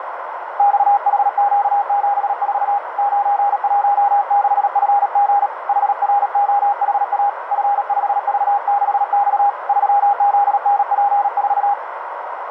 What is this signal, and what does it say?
Morse code, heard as a keyed tone, hand-sent with a paddle, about 37 wpm, 810 Hz, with radio static and a narrow filter. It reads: XHQ74 916FG HROHA F5V6X 3ZNP4